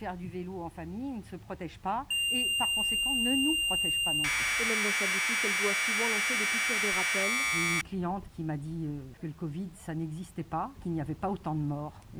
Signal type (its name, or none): Commodore tape loading